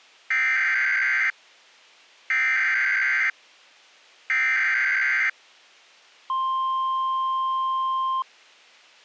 Emergency Alert System (SAME) tones (header bursts, then the 1050 Hz attention tone), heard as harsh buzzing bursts, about 520.83 baud.